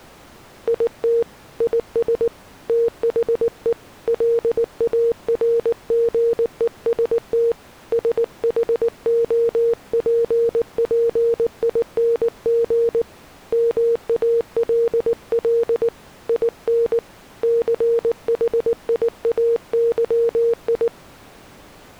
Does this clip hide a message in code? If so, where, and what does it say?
Yes: Morse code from 0.6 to 20.9 s, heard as a keyed tone, hand-sent with a paddle, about 19 wpm, 460 Hz. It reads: IT IS THE LARGEST SHOPPING MALL IN CHIAYI